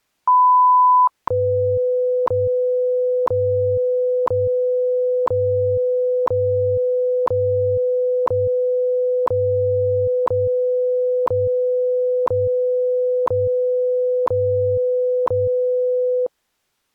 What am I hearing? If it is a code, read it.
Radio time signal (WWV, Colorado), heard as ticks, one a second.